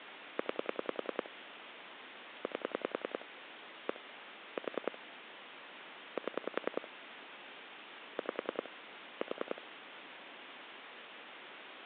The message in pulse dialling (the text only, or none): 9 8 1 4 7 5 4